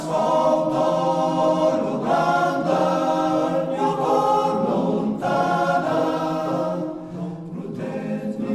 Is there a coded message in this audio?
No.